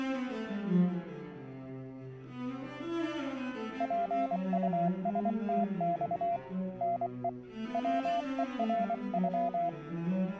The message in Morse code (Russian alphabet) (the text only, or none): ПУСТЬ НЕ ВЕРЮ